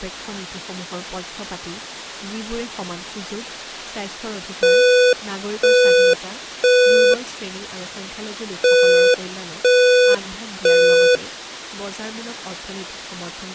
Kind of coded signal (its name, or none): alarm pattern